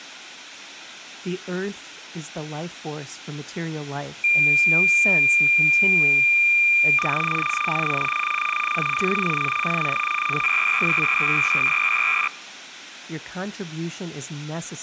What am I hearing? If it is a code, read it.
Cassette data (Kansas City type), 300 baud, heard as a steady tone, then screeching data, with speech in English.